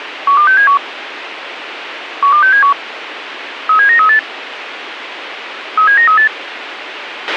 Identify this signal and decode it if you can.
Five-tone selective call (CCIR), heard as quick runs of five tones, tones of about 100 ms, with radio hiss and a squelch burst at the end. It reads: 12671 12671 37938 37938